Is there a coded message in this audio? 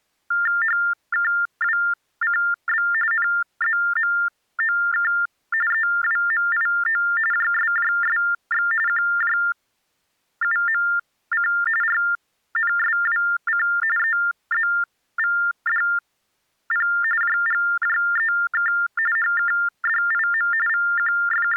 Yes: TTY/TDD text telephone tones (45.45 baud Baudot) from 0.3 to 21.6 s, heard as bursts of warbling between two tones, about 400 Hz shift, 1600 Hz centre. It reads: HKWCB NZMOK EWMIO JSJSX QJUMC RNSWC EZVDP JGJEK HKDIM …